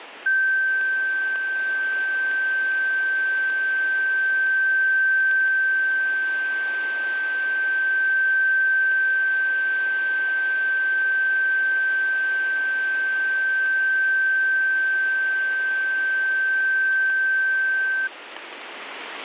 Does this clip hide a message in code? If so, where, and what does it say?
No, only a steady tone, with radio static.